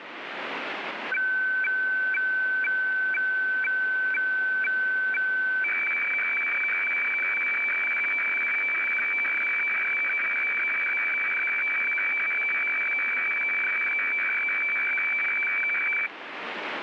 Weather fax (radiofax), 120 lines a minute, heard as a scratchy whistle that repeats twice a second, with radio static.